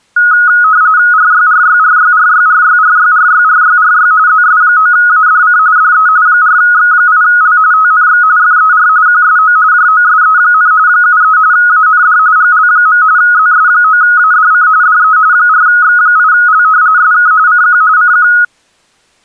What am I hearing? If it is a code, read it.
RTTY (45.45 baud, 170 Hz shift), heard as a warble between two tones, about 1360 Hz centre. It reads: RYRYRYRYRYRYRYRYRY ZS9ADC DE 4X8L TNX FER QSO JOSE, 73 AND GL. ZS9ADC DE 4X8L SK CQ CQ